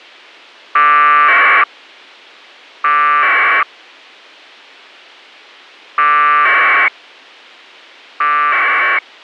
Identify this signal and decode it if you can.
Packet radio (AX.25, as in APRS), 1200 baud, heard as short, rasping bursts.